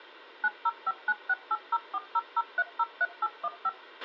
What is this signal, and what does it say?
DTMF, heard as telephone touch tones, dialled by machine, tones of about 40 ms, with a squelch burst at the end. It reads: 9059680400303815